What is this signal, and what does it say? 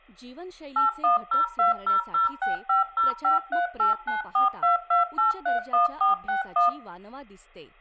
DTMF, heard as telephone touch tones, dialled by machine, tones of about 140 ms, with room echo and speech in Marathi. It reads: 8102006505389422831461